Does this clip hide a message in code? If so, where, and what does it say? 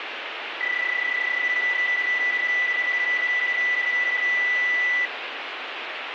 Yes: PSK31 (31.25 baud) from 0.6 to 5.1 s, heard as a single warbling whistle, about 2000 Hz, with radio static.